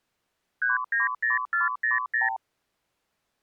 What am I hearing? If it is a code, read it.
Multi-frequency trunk signalling (R2, with the far end's replies), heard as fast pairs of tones, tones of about 150 ms. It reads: 390400